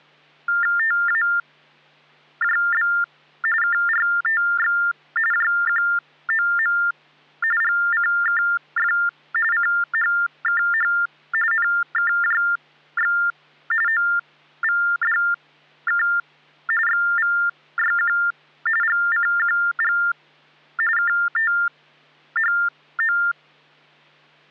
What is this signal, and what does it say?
TTY/TDD text telephone tones (45.45 baud Baudot), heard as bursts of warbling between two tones, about 400 Hz shift, 1600 Hz centre. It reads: TAJB KRTX JQOM GCKF CHKH NKJX OVDK XVYQ GCQG KTHO